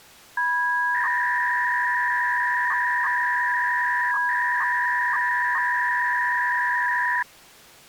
300-baud modem data (V.21 tones), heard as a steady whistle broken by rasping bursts, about 300 baud, 200 Hz shift.